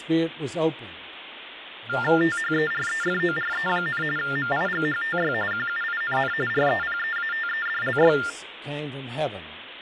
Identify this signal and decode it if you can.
TTY/TDD text telephone tones (45.45 baud Baudot), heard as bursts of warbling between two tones, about 400 Hz shift, 1600 Hz centre, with phone line noise. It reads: THEREFORE, MIGHTY QUINN REPEATEDLY